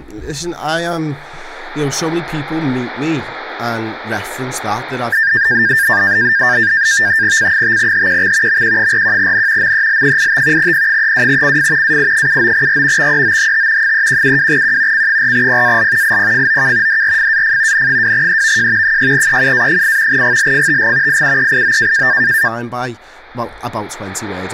NAVTEX (SITOR-B), 100 baud, 170 Hz shift, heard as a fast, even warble, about 1700 Hz centre, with speech in English. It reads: C5HQX MQ41N MEL85 P32CF AI79R XEOHT 3172Q C4PAL IPFOK DRFAF N2EVJ 6EUA8 GLFTG IUEIO